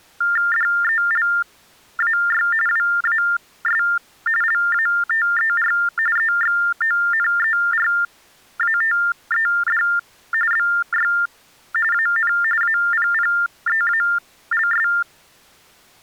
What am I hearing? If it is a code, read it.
TTY/TDD text telephone tones (45.45 baud Baudot), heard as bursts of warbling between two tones, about 400 Hz shift, 1600 Hz centre. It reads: DELAY WAS LATER EXONERATED BY AN APPEALS